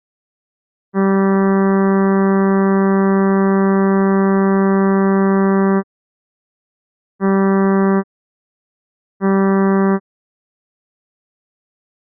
Ship horn signal, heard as a ship's horn, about 190 Hz. 1 long, 2 short. At sea: a vessel in fog that is sailing, fishing, towing or hampered.